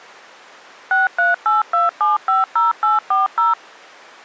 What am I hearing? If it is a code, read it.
DTMF, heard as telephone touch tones, dialled by machine, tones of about 160 ms. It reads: 6382750840